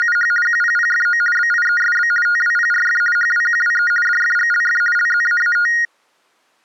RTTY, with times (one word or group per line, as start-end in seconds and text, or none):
0.0-0.3 …
0.5-1.2 QPPFO
1.4-2.1 BIESB
2.3-3.0 TWPRF
3.2-3.9 HWQWE
4.1-4.8 DFGLF
5.0-5.7 LZAAT